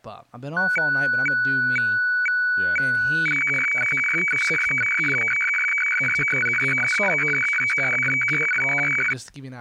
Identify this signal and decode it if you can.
Weather fax (radiofax), 120 lines a minute, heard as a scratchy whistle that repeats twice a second, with speech in English.